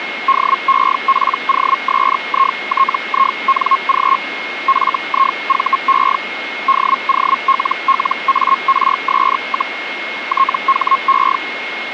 Hellschreiber (Feld-Hell, 122.5 baud), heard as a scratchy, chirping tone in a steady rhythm, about 1080 Hz, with radio static and a steady whistle near 2160 Hz. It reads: DEPOSITING FIVE DOLLARS, THE